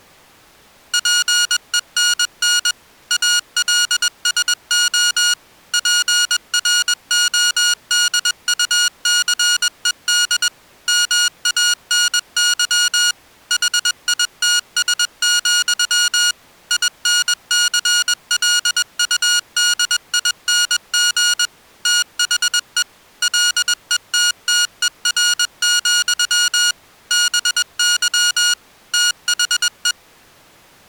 Morse code, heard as electronic beeps, machine-sent, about 21 wpm, 1440 Hz. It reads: PENN ALSO PRODUCED MANY HITS, INCLUDING THE LETTER, BY THE